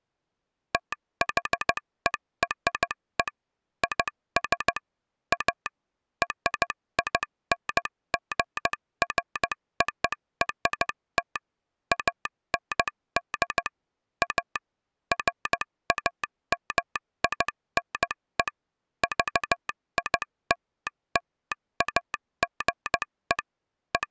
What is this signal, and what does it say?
Morse code (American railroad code), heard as a telegraph sounder, machine-sent. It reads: THERE IS A RINGFORT AND A FAMINE VILLAGE …